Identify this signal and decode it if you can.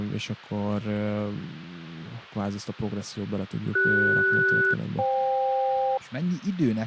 Aircraft SELCAL, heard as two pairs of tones, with speech in Hungarian. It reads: CS-FK